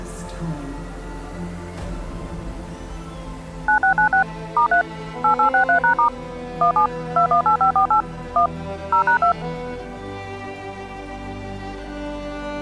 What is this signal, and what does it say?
DTMF, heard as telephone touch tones, dialled by machine, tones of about 100 ms. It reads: 9696 *3 8863#* 17 218548 1 0#2